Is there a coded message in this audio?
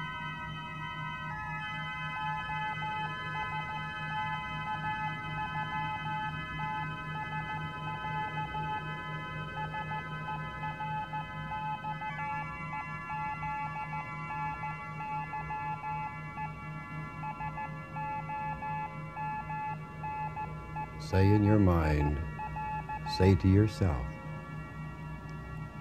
Yes: Morse code (Russian alphabet) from 2.1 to 23.4 s, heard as a keyed tone, hand-sent with a paddle, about 14 wpm, 860 Hz, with room echo. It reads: ОСТАЮТСЯ СЕРЬЕЗНЫЕ СОМНЕНИЯ